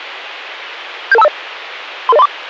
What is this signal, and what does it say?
Five-tone selective call (EIA), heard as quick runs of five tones, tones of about 30 ms. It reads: 77250 33034